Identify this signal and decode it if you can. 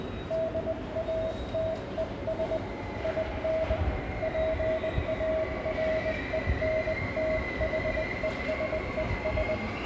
Morse code, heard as a keyed tone, hand-sent with a bug key, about 20 wpm, 640 Hz, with room echo and the noise of a subway station. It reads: DATES IN PARENTHESES